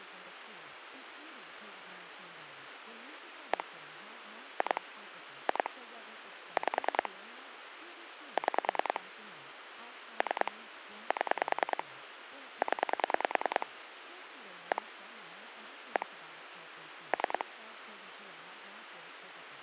Pulse dialling, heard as clicks on a phone line, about 10 pulses a second, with phone line noise and speech in English. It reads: 1 2 2 5 6 3 7 0 1 1 3